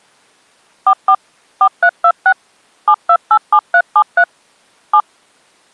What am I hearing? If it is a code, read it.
DTMF, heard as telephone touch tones, dialled by machine, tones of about 70 ms. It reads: 44 4326 7287373 7